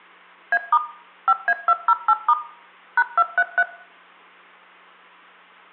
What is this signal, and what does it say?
DTMF, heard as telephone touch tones, dialled by machine, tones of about 50 ms, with room echo. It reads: A* 5A208* #233